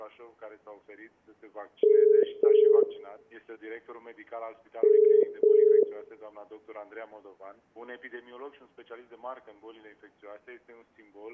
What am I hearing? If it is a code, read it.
Telephone call progress tone (as in the UK, Ireland, Australia and similar networks), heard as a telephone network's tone, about 430 Hz, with room echo. Ringback tone.